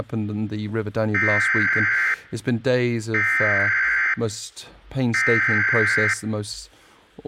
Emergency Alert System (SAME) tones (header bursts), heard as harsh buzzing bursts, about 520.83 baud, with speech in English.